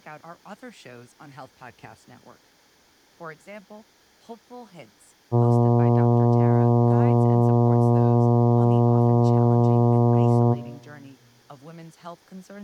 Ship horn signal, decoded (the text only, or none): 1 long